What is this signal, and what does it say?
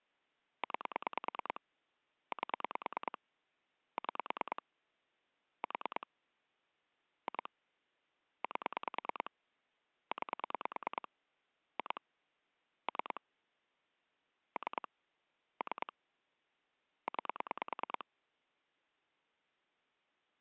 Pulse dialling, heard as clicks on a phone line, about 9 pulses a second. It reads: 9 8 6 4 2 8 9 2 3 3 3 9